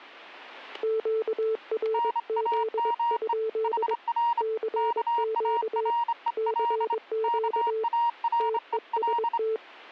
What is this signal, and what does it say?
Morse code, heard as two keyed tones, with static crashes. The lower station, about 22 wpm, 440 Hz: QRZ? CQ CQ TEST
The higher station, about 27 wpm, 940 Hz: NAME HR KAREL KAREL